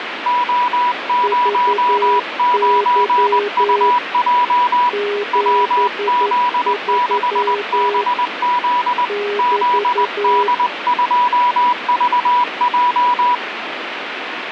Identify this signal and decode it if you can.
Morse code, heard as two keyed tones, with radio static. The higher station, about 20 wpm, 980 Hz: O09UJ WZ6BZ ZD2VJ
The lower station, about 11 wpm, 410 Hz: VY 73 <BT>